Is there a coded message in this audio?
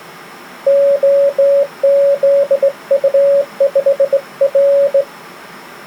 Yes: Morse code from 0.6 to 5.1 s, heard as a keyed tone, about 19 wpm, 560 Hz. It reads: OZU5R